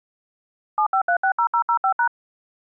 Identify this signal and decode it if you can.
DTMF, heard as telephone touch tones, dialled by machine, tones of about 90 ms. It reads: 75360005#